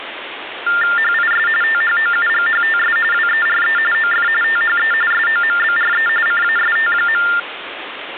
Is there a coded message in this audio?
Yes: TTY/TDD text telephone tones (45.45 baud Baudot) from 0.7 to 7.4 s, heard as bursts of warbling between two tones, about 400 Hz shift, 1600 Hz centre, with phone line noise. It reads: HIS THOUGHTS WERE OF THE SOMBRE CAST.